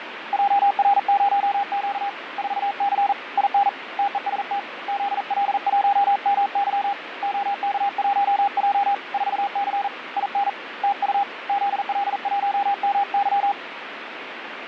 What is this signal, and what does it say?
Morse code, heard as a keyed tone, hand-sent with a paddle, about 40 wpm, 800 Hz, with radio static and fading. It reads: JR0Q 4C IN TEST ZL1MY OK1J 4C IN TU ZL1MY